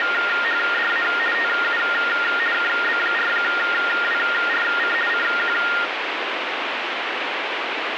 RTTY (50 baud, 450 Hz shift), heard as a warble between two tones, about 1650 Hz centre, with radio static. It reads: … TU KB4WRC CQ